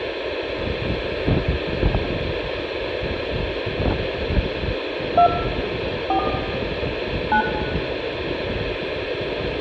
DTMF, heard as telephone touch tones, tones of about 90 ms, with phone line noise, room echo and the noise of a residential street. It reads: 2 4 9